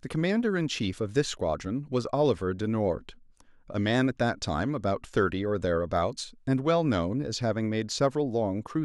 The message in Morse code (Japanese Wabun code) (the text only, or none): none